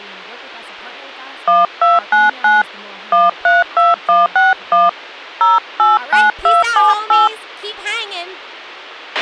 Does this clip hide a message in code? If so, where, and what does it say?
Yes: DTMF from 1.5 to 7.3 s, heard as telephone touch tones, dialled by hand, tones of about 170 ms, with a squelch burst at the end and speech in English. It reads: 1299 132161 089278